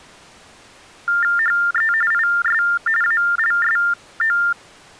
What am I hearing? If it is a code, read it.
TTY/TDD text telephone tones (45.45 baud Baudot), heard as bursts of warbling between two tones, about 400 Hz shift, 1600 Hz centre. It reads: HE IS ALSO